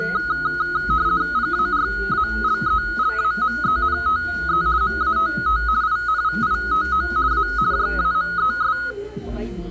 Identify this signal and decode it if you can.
RTTY (50 baud, 170 Hz shift), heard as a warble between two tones, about 1360 Hz centre, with room echo and the noise of a restaurant. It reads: PARALELAMENTE MATT INVITO A JAMES